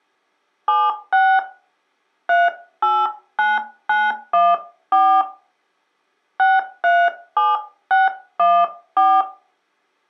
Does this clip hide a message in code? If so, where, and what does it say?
Yes: DTMF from 0.7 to 9.2 s, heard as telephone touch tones, dialled by hand, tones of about 230 ms. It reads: 76 389914 637614